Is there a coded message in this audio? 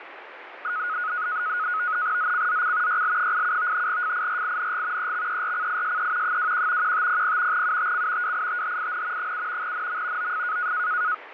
Yes: NAVTEX (SITOR-B), 100 baud, 170 Hz shift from 0.6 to 11.1 s, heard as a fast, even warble, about 1360 Hz centre, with radio static. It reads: ZCZC YL87 FIRING EXERCISE 21 1500 UTC WITHIN 7 NM OF